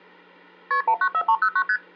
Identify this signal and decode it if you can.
Multi-frequency trunk signalling (R1, as on North American trunks), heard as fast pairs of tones, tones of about 70 ms, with hum. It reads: KP 194309 ST